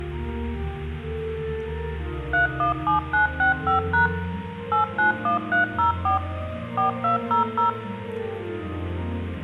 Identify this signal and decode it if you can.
DTMF, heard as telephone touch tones, dialled by machine, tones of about 130 ms, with room echo. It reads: 317965# 891304 4200